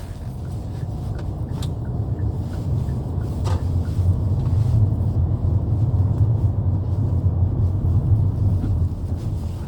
The noise inside a car. There is no code.